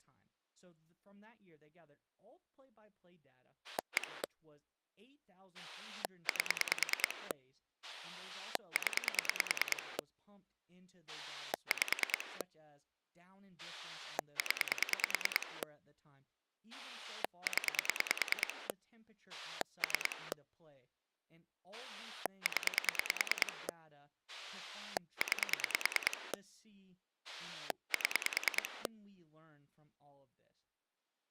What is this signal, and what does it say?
Pulse dialling, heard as a rotary dial, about 9 pulses a second, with speech in English. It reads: 1 8 0 5 0 0 3 0 9 7